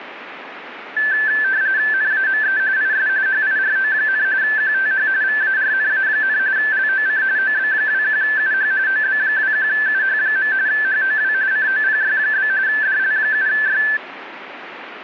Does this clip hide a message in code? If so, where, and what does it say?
Yes: RTTY (45.45 baud, 170 Hz shift) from 1.0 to 14.0 s, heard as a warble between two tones, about 1650 Hz centre, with radio static. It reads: NAME IS HIRO, QTH VARNA, LOC OB21UH OB21UH. HOW COPY? DL7Y